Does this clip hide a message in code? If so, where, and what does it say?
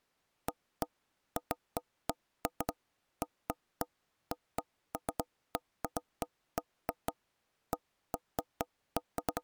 No, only irregular knocks on wood.